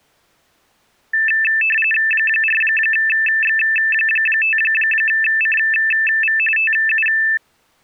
RTTY (45.45 baud, 850 Hz shift), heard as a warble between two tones, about 2200 Hz centre. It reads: 4X5CV TU